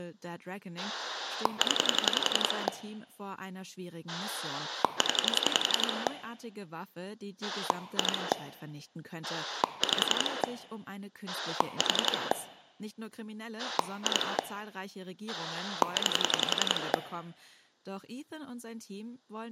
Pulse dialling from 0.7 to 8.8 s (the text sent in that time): 0 0 2